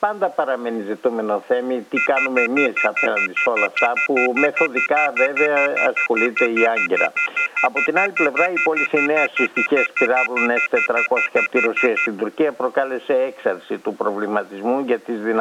Telephone call progress tone (North American plan), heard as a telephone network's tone, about 1400, 2050, 2450, 2600 Hz, 0.1 s on and 0.1 s off. Off-hook warning tone.